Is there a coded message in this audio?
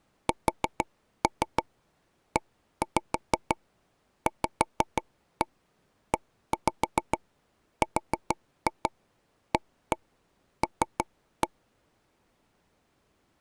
Yes: tap code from 0.3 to 11.5 s, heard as taps on a table, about 6 knocks a second. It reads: SEVERAL